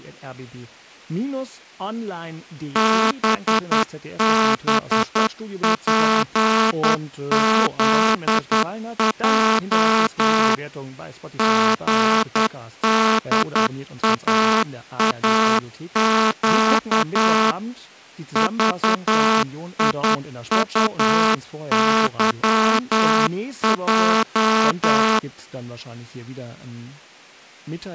Morse code, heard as a buzzer, machine-sent, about 10 wpm, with speech in German. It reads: BBPZJ GDAAQ VIUYJ